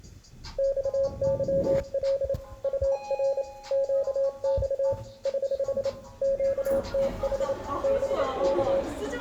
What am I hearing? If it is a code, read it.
Morse code, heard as a keyed tone, hand-sent with a paddle, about 28 wpm, 550 Hz, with room echo and the noise inside a lift. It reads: XYL UR QX <HH> QTH BK